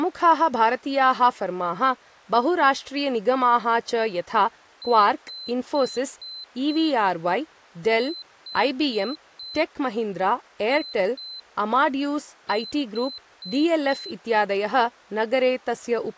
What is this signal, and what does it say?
Beep code, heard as a piezo beeper, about 4050 Hz, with speech in Sanskrit. 5-4-2-4.